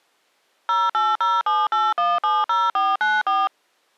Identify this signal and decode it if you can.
DTMF, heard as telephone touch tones, dialled by machine, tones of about 200 ms. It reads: 08078170494